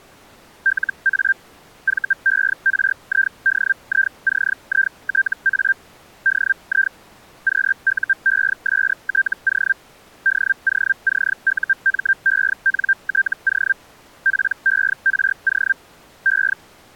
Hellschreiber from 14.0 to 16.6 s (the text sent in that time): PERO E